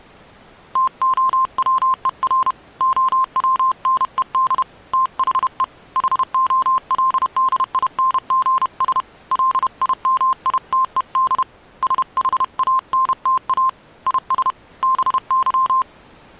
Morse code, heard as a keyed tone, hand-sent with a paddle, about 31 wpm, 1050 Hz. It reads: TOWER OWNED THE HOLDINGS LIMITED SHANTA IS BY